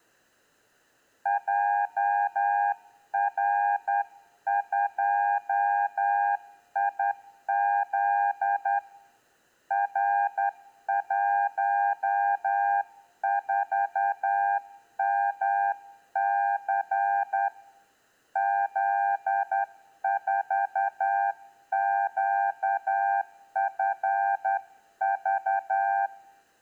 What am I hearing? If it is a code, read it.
Morse code, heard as a keyed tone, hand-sent with a straight key, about 10 wpm, 800 Hz, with room echo. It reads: JR2IZ R14MC Z4QFV